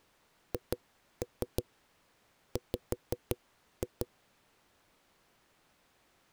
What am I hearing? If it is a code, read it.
Tap code, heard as knocks on a wall, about 5 knocks a second. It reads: HW